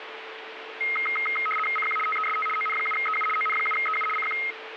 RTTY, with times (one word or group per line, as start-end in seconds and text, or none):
1.8-2.0 CQ
2.1-2.5 TEST
2.6-3.3 ON7EU
3.4-4.1 ON7EU
4.2-4.4 CQ